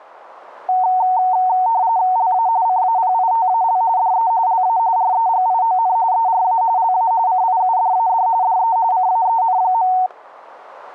RTTY (45.45 baud, 170 Hz shift), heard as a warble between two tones, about 830 Hz centre, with static crashes. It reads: LA CAPITAL DE LA REGION ERA LA CIUDAD DE CAEN.